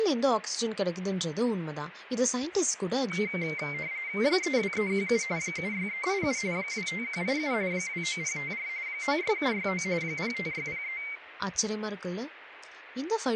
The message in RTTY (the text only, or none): 32317 76387 25187 29054 96769 05603